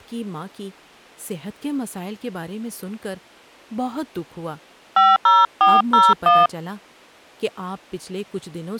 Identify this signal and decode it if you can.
DTMF, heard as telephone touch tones, dialled by hand, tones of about 200 ms, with speech in Urdu. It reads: 50401